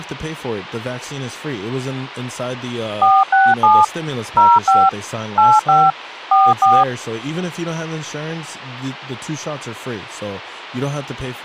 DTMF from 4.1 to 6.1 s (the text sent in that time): 05 85